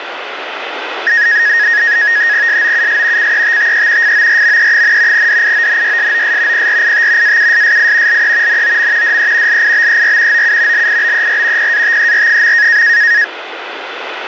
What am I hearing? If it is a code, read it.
NAVTEX (SITOR-B), 100 baud, 170 Hz shift, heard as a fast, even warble, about 1750 Hz centre, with radio static. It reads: SOUS CETTE FORME, DIONYSOS PRIT AUSSI LE NOM DE LIBER OU LIBER PATER.